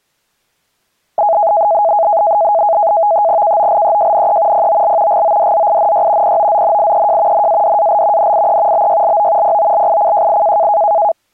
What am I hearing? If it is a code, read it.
NAVTEX (SITOR-B), 100 baud, 170 Hz shift, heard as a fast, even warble, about 740 Hz centre. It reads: KOLEJNE POL GODZINY POZNIEJ NADAL NIE BYLO POLICJI